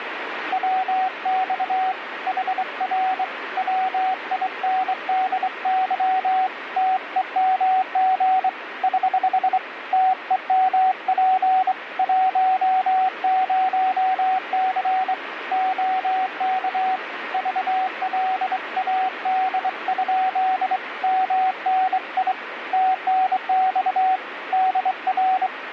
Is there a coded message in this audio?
Yes: Morse code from 0.5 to 25.5 s, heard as a keyed tone, hand-sent with a straight key, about 24 wpm, 750 Hz, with radio static. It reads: WX HR WINDY TEMG <HH> TEMP 10C OK VLAD? MNI TNX DR